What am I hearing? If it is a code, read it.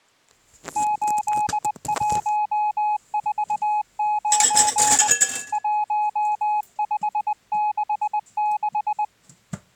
Morse code, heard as a keyed tone, hand-sent with a paddle, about 20 wpm, 840 Hz, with kitchen noise. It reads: 8149 1566